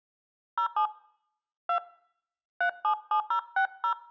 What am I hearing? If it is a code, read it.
DTMF, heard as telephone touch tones, dialled by hand, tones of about 90 ms. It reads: 07 2 377060